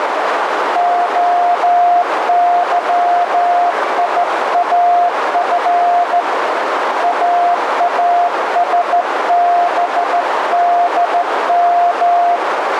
Morse code, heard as a keyed tone, hand-sent with a straight key, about 14 wpm, 700 Hz, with heavy radio static and a narrow filter. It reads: OYIAF AASBDM